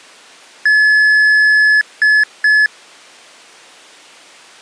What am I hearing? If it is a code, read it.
Beep code, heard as beeps, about 1700 Hz. 1 long, 2 short. In Award, IBM and AMI BIOS tables: video adapter failure.